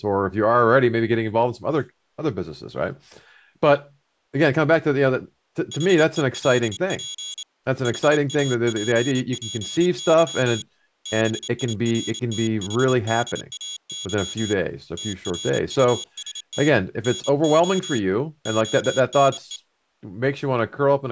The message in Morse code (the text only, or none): HELP HAPPY BIRTHDAY TRUST NO ONE